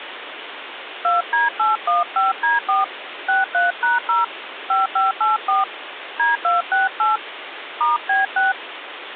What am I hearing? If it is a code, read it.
DTMF, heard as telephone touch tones, dialled by hand, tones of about 160 ms, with phone line noise. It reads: 2D815D4 63#0 5584 D268 *B6